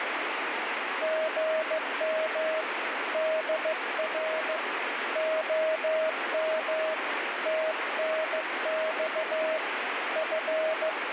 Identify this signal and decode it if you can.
Morse code, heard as a keyed tone, hand-sent with a paddle, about 15 wpm, 630 Hz, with heavy radio static. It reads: GM DR OM TNX …